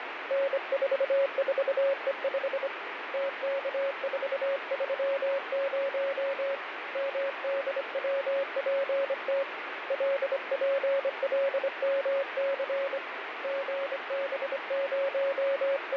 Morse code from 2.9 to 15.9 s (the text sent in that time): TK430 MDWPT LPLMC …